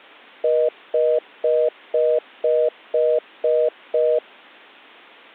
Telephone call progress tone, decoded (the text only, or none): congestion tone